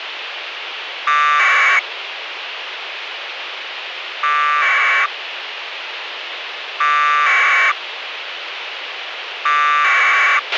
Packet radio (AX.25, as in APRS), 1200 baud, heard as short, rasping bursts, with radio hiss and a squelch burst at the end.